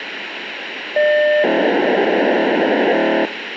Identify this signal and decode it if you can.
POCSAG pager data (1200 baud), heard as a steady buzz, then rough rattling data, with radio hiss.